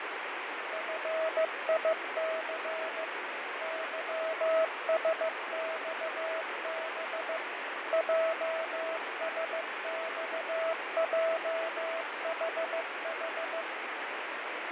Morse code, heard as a keyed tone, machine-sent, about 15 wpm, 650 Hz, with heavy radio static and fading. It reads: FIC YSXB JSXJHH